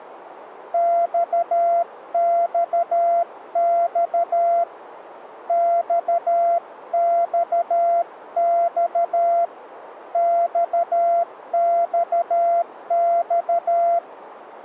Morse code, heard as a keyed tone, hand-sent with a paddle, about 13 wpm, 680 Hz, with radio static. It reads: XXX XXX XXX